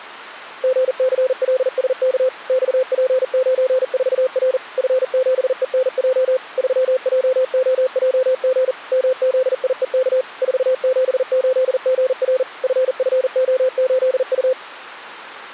Morse code, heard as a keyed tone, machine-sent, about 40 wpm, 520 Hz. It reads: GCLSK XP94R F7ENJ 3JOJG MZIEK 478GR FFO8U